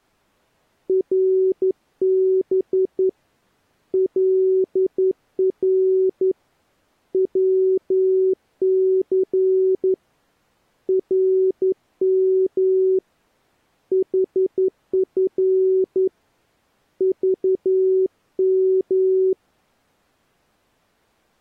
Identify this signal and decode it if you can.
Morse code, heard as a keyed tone, hand-sent with a straight key, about 11 wpm, 380 Hz. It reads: RB LR WC RM HF VM